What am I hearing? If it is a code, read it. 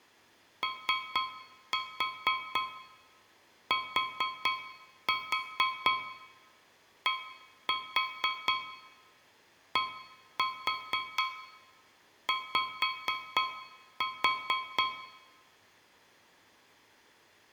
Tap code, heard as taps on a metal pipe, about 4 knocks a second, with room echo. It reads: OTDDY